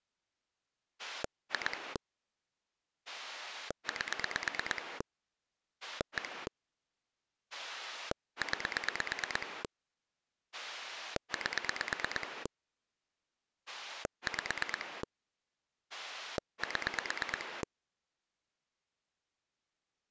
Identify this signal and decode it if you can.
Pulse dialling, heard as a rotary dial, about 8 pulses a second. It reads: 2 8 1 9 8 5 7